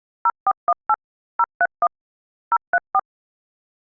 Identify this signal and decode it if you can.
DTMF, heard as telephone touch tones, dialled by machine, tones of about 50 ms. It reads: 0418 031 034